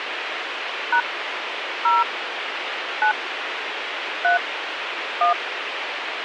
DTMF, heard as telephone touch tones, dialled by hand, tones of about 130 ms, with radio hiss. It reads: # 0 9 3 1